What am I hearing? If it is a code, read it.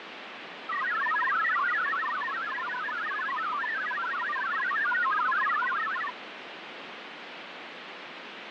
Multi-tone FSK (Olivia or MFSK type), about 1000 Hz wide, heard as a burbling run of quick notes, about 62.5 baud, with radio static.